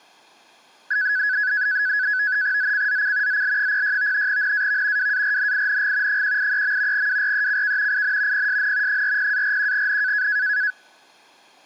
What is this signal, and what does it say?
NAVTEX (SITOR-B), 100 baud, 170 Hz shift, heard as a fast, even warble, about 1600 Hz centre. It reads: ZCZC ZL06 NAV WARNING 183. WRECK IN PSN 40-41N